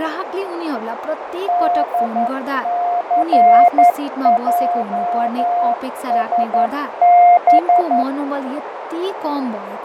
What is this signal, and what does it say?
Morse code, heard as a keyed tone, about 11 wpm, 710 Hz, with radio static, fading, a narrow filter and speech in Nepali. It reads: DCJSB